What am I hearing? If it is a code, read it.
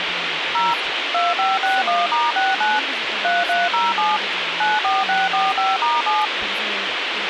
DTMF, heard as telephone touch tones, dialled by machine, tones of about 190 ms, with radio hiss and speech in English. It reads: 0 2561*69 3307 94645*7